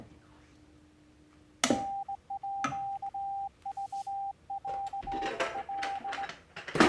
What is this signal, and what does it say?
Morse code (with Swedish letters), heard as a keyed tone, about 18 wpm, 790 Hz, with kitchen noise. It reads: NÅVÄL